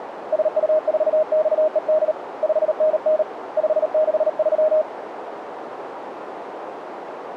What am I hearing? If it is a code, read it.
Morse code, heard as a keyed tone, hand-sent with a paddle, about 38 wpm, 620 Hz, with radio static and a narrow filter. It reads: SU4XED 5NN 563